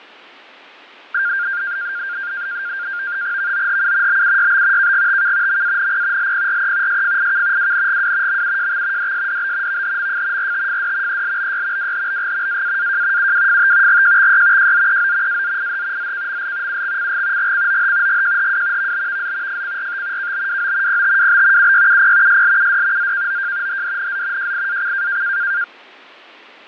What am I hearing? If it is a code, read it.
NAVTEX (SITOR-B), 100 baud, 170 Hz shift, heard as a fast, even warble, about 1500 Hz centre, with fading. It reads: VOHU BUYB KGTK MANP LPRE SFIK WNGW MUJX DSDB VHMF RTFD ELBY WHBG AAAJ UWFT GJXY JZEO AZIH ZKML UXCG GCOH GJHW VBVZ FCRT KBWO PTWB UYUP SLUD ZKOJ HDNZ JIAC